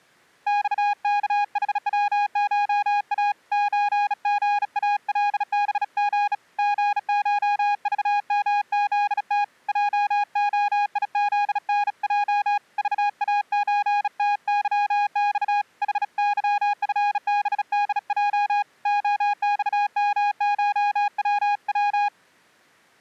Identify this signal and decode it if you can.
Morse code (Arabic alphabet), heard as a keyed tone, hand-sent with a bug key, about 36 wpm, 820 Hz. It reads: صكحوشا زغالبغ غشضمذت جخيذنج ضازتظص حظفبدج خصمشوو